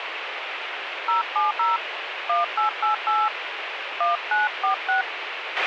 DTMF, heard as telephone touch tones, dialled by hand, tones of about 150 ms, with radio hiss and a squelch burst at the end. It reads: 070 1888 1946